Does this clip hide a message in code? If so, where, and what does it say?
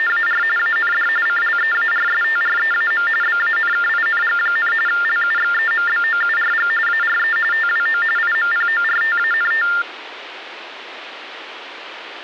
Yes: TTY/TDD text telephone tones (45.45 baud Baudot) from 0.0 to 9.8 s, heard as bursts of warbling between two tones, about 400 Hz shift, 1600 Hz centre, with phone line noise. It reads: … AND CLEARSTREAM BANKING, LUXEMBOURG ARE TWO IMPORTANT